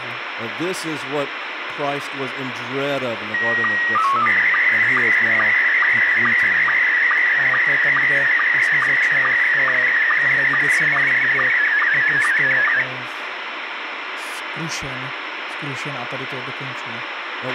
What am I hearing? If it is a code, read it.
SSTV (slow-scan television), Scottie S1, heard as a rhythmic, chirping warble, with radio hiss, a squelch burst at the end, room echo and speech in Czech.